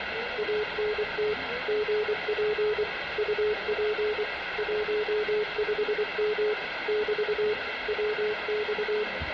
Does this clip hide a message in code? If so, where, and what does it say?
Yes: Morse code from 0.3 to 9.1 s, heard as a keyed tone, machine-sent, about 24 wpm, 420 Hz, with radio static, room echo and the noise inside a subway train. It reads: ANT GP UP 15M <BT> WX